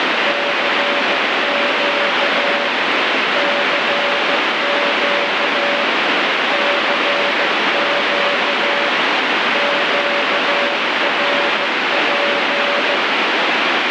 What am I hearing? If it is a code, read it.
Morse code, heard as a keyed tone, hand-sent with a bug key, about 15 wpm, 570 Hz, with heavy radio static. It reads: CQ CQ CQ QRP